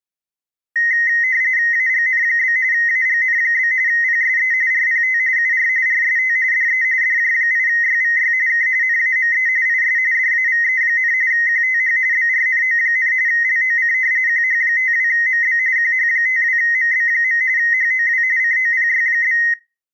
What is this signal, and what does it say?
RTTY (45.45 baud, 170 Hz shift), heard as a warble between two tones, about 1950 Hz centre. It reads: AGN? AGN? PSE RPT UR RST DE DJ8YVY K NAME IS DAVE, QTH BRNO, LOC QH52MB QH52MB. HOW COPY?